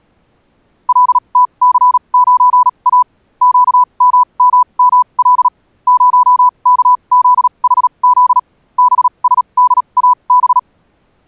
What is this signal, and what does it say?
Morse code, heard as a keyed tone, machine-sent, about 37 wpm, spaced as for 29 wpm, 1000 Hz. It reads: LTC9A QMMML 0KZHZ BSDAB